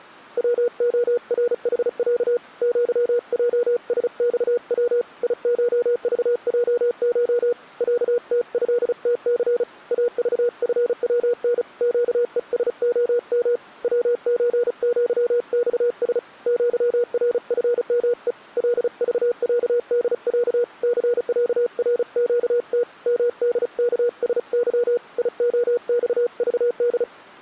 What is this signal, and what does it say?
Morse code (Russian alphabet), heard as a keyed tone, hand-sent with a paddle, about 35 wpm, 480 Hz. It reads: ВОРХЯ ЪЙСЬВ ИШЖЙШ ЯТЭТЦ АЖФВН ЩЕСОМ ВЧЪЬС ЪРФМЕ ЛЖЯДЯ ЦЯРЩТ МДКСЫ ИОЬЖД